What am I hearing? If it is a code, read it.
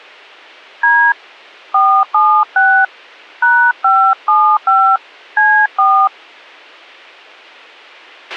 DTMF, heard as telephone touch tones, dialled by hand, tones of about 290 ms, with a squelch burst at the end. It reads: D 476 #575 C4